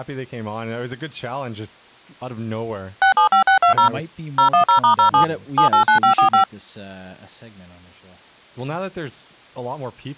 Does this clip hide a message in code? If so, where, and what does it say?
Yes: DTMF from 3.0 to 6.4 s, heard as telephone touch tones, dialled by machine, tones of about 110 ms, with speech in English. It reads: 675620 010*07 789545